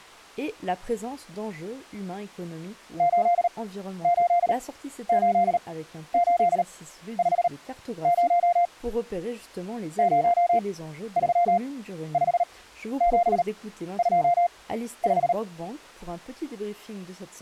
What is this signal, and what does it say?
Morse code, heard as a keyed tone, machine-sent, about 38 wpm, spaced as for 13 wpm, 700 Hz. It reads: 888850 035725